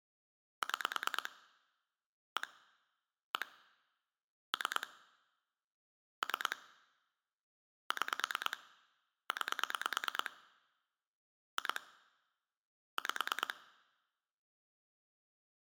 Pulse dialling, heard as clicks on a phone line, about 9 pulses a second. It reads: 6 1 1 3 3 6 9 2 5